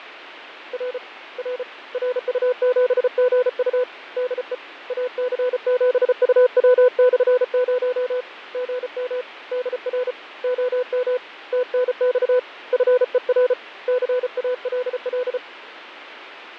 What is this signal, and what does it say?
Morse code, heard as a keyed tone, hand-sent with a paddle, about 34 wpm, 500 Hz, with radio static and fading. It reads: R R RU7GU DE AC7UW/0 GM DR OM TNX FER CALL